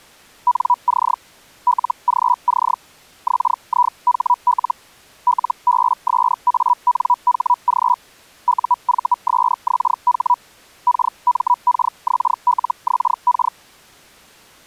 Hellschreiber (Feld-Hell, 122.5 baud), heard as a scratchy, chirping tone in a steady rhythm, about 980 Hz. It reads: NC LGC XIHL LBSANHG UVSXH KMKXLXK